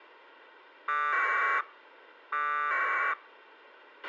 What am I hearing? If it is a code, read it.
Packet radio (AX.25, as in APRS), 1200 baud, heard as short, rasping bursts, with a squelch burst at the end.